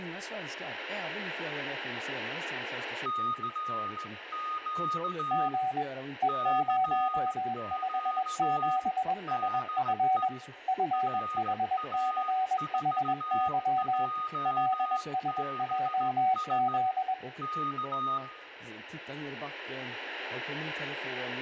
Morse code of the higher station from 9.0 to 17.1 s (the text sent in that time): DE RA4JBS